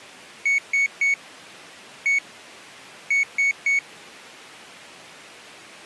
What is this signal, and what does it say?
Beep code, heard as a piezo beeper, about 2200 Hz. 3-1-3. In Phoenix BIOS tables: interrupt mask register failure.